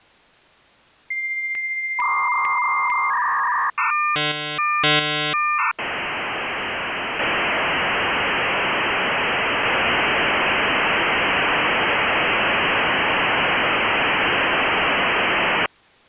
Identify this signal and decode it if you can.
Dial-up modem handshake (V.34 or later), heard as a whistle, warbles, then hiss.